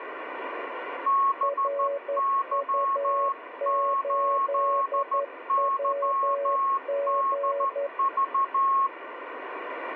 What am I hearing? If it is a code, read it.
Morse code, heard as two keyed tones, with radio static. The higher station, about 13 wpm, 1090 Hz: BY8YDV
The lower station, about 11 wpm, 560 Hz: RU8WG